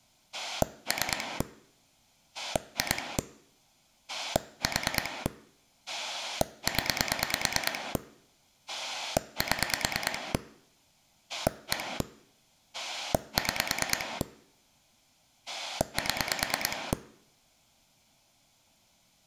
Pulse dialling, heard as a rotary dial, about 9 pulses a second. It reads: 3 2 4 0 7 1 6 7